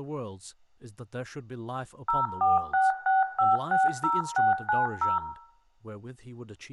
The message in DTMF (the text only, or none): 0466560690